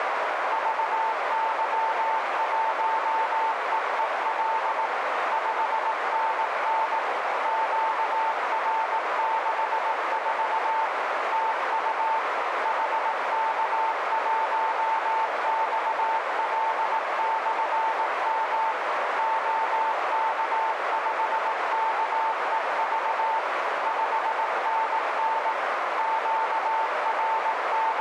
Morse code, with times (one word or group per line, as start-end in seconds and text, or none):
0.5-4.9 VY1EEL
5.3-7.0 5NN
7.5-10.9 QR64
11.3-12.2 TU
12.7-18.7 HK1XL/M
19.2-23.4 OK5KEV
23.9-25.5 5NN
26.0-28.0 …